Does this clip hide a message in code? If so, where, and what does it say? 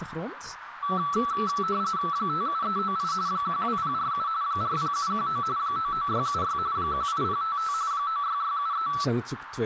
Yes: RTTY (45.45 baud, 170 Hz shift) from 0.8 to 9.0 s, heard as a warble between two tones, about 1230 Hz centre, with radio static, a narrow filter and speech in Dutch. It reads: 57398 12047 40719 99676 18055 96673